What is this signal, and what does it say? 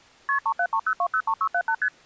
Multi-frequency trunk signalling (R1, as on North American trunks), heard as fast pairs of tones, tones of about 70 ms. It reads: KP 3730203678 ST